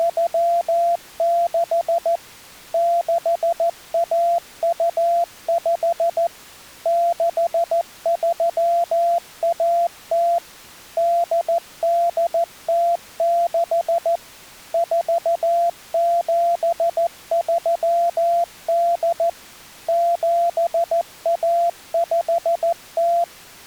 Morse code (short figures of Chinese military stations), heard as a keyed tone, machine-sent, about 14 wpm, 690 Hz. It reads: … 6125 6310 8806 4738 7150